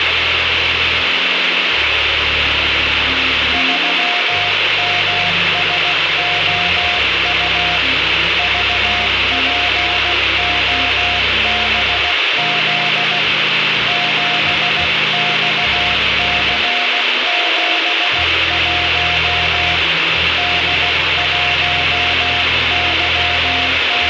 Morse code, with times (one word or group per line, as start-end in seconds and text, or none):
3.5-7.8 3MSOU
8.4-13.2 VPOBZ
13.9-19.8 7XC71
20.4-24.1 …